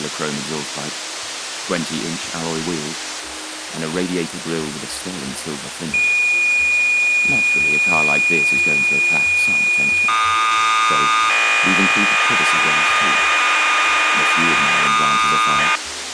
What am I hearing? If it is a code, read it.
Cassette data (Kansas City type), 1200 baud, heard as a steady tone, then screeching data, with tape hiss.